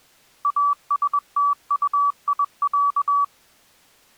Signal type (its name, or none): Morse code